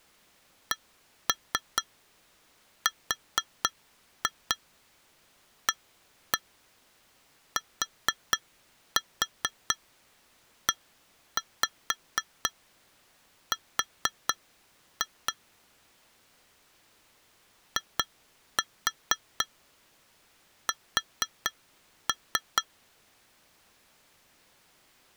Tap code, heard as taps on glass, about 4 knocks a second. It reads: CRATER IS